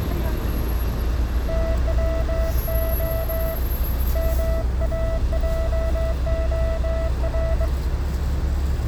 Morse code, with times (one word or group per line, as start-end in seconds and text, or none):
1.5-3.5 TWO
4.2-7.7 MAJOR